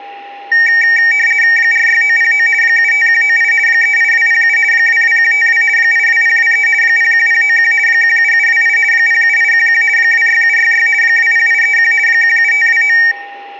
RTTY (50 baud, 450 Hz shift), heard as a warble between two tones, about 2050 Hz centre, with a steady whistle near 800 Hz. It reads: 46909 75198 38207 22152 82023 01091 17728 07811 26766 20831 17529